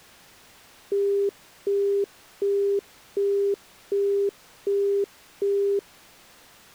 Telephone call progress tone (as in the UK, Australia and similar networks), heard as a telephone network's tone, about 400 Hz, 0.375 s on and 0.375 s off. Busy tone.